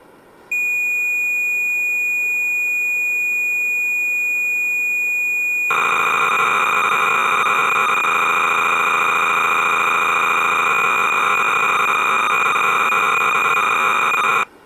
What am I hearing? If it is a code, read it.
Cassette data (Kansas City type), 300 baud, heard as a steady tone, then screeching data.